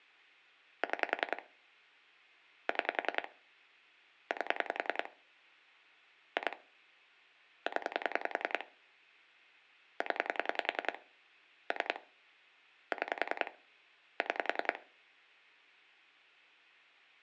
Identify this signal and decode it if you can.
Pulse dialling, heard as clicks on a phone line, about 10 pulses a second, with hum. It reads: 6 6 8 2 0 0 3 6 6